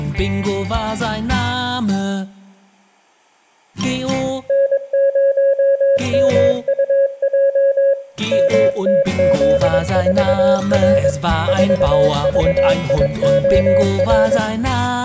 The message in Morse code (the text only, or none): N0MUJ MTZ4R 4VIOR